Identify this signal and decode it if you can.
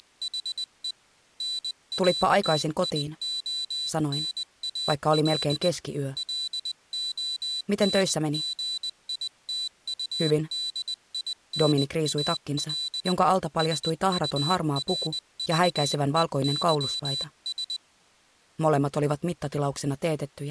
Morse code, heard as a high beeper, hand-sent with a paddle, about 20 wpm, 4000 Hz. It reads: … NATIONAL LONGITUDINAL SURVEYS